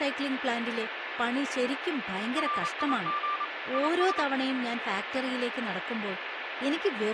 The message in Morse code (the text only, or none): RIG IS